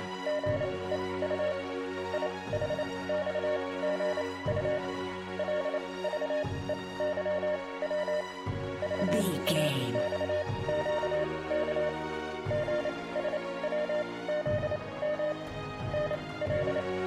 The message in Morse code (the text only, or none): … IHXGU LVEYW VAXQK GSWZM …